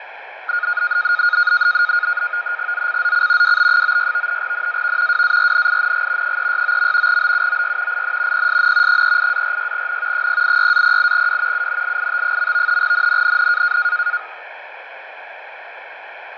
NAVTEX (SITOR-B), 100 baud, 170 Hz shift, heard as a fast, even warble, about 1340 Hz centre, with radio static and fading. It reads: ZCZC WB96 NAV WARNING 369. BUOY IN PSN 38-46N 086-08W UNLIT. NNNN